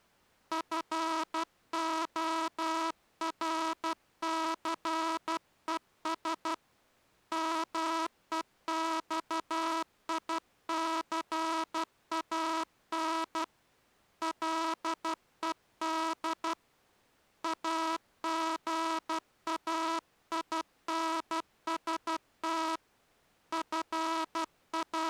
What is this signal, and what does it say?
Morse code, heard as a buzzer, hand-sent with a paddle, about 12 wpm. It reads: FORCES MEXICAN LED AGAINST …